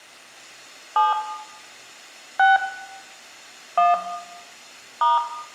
DTMF, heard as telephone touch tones, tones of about 170 ms, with room echo. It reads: 7 6 1 *